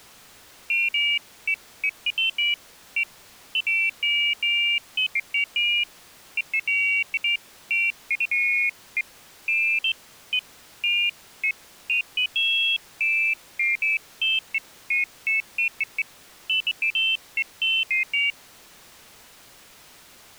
Pairs of high tones at irregular times. There is no code.